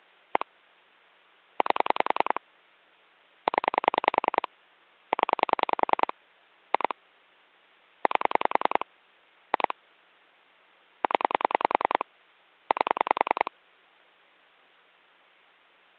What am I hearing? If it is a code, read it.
Pulse dialling, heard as clicks on a phone line, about 10 pulses a second. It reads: 1 8 0 0 2 8 2 0 8